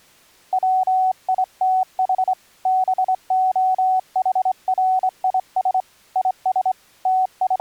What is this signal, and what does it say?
Morse code, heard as a keyed tone, hand-sent with a straight key, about 24 wpm, 750 Hz. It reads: WITH BOHRIS IS …